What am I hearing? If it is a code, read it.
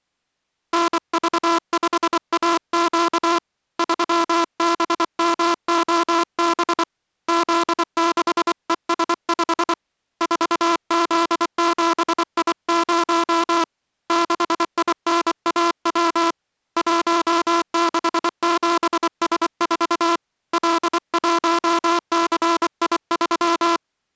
Morse code, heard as a buzzer, hand-sent with a paddle, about 24 wpm. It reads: NV5AQ 3BMOB Z6ES5 4Z7I0 6INAW 167S4 L1CI3